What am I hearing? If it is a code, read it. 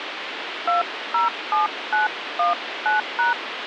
DTMF, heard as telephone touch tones, dialled by hand, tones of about 140 ms, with phone line noise. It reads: 207919#